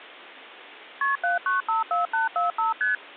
Multi-frequency trunk signalling (R1, as on North American trunks), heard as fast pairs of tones, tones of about 140 ms. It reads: KP 7954845 ST